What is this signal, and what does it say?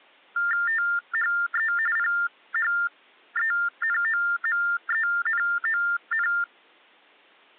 TTY/TDD text telephone tones (45.45 baud Baudot), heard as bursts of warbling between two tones, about 400 Hz shift, 1600 Hz centre. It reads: THE PHENOMENON